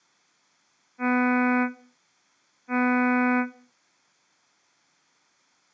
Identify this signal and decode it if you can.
Ship horn signal, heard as a ship's horn, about 250 Hz, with room echo. 2 short. At sea: I am altering course to port.